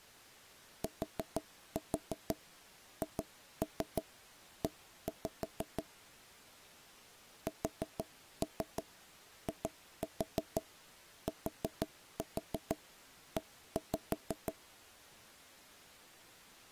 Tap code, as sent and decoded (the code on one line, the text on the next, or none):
4-4 2-3 1-5 / 4-3 2-4 4-4 1-5
THE SITE